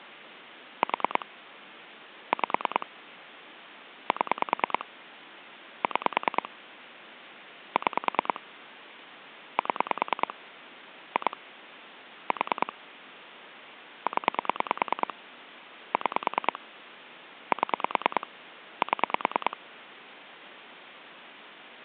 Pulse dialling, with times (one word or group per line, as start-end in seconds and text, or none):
0.8-1.3 4
2.3-2.9 5
4.1-4.9 7
5.8-6.5 6
7.8-8.4 6
9.6-10.3 7
11.2-11.4 2
12.3-12.7 4
14.1-15.1 0
15.9-16.6 6
17.5-18.3 7
18.8-19.6 7